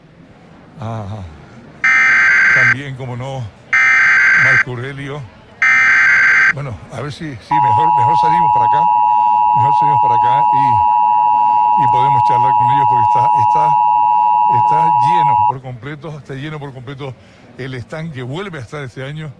Emergency Alert System (SAME) tones (header bursts, then the 853 and 960 Hz attention tone), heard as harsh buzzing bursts, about 520.83 baud.